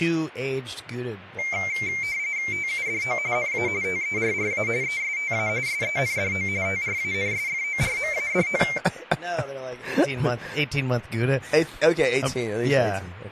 RTTY (45.45 baud, 170 Hz shift), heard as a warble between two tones, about 2200 Hz centre, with speech in English. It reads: TUDO NA TERRA ESTA SENDO TRANSFORMADO